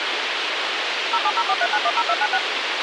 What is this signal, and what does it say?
DTMF, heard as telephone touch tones, dialled by machine, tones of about 50 ms, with radio hiss and a squelch burst at the end. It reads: 07043910296